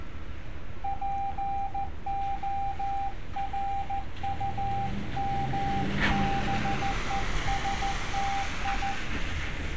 Morse code, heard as a keyed tone, hand-sent with a paddle, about 14 wpm, 790 Hz, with street noise. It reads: PORUMBESTI